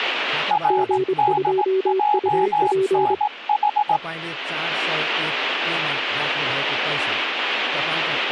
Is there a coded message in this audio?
Yes: Morse code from 0.4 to 4.0 s, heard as two keyed tones, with speech in Nepali. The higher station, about 18 wpm, 840 Hz: RDJNH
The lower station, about 25 wpm, 380 Hz: G2UP